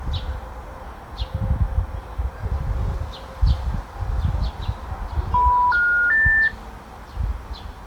Telephone call progress tone (North American plan), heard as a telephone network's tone, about 980, 1430, 1800 Hz, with the noise of a park. Special information tone.